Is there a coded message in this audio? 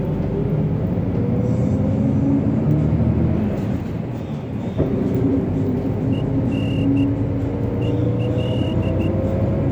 Yes: Morse code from 6.1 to 9.1 s, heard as a whistle, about 13 wpm, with the noise inside a bus. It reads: EN EL